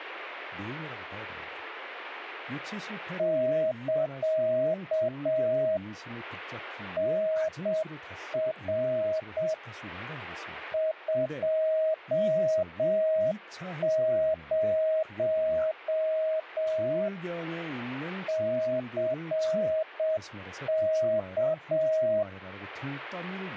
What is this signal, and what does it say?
Morse code, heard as a keyed tone, machine-sent, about 7 wpm, 630 Hz, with speech in Korean. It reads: <KA> NR 20 CK